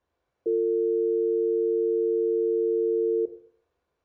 Telephone call progress tone (North American or UK plan), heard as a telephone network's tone, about 350, 450 Hz, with room echo. Dial tone.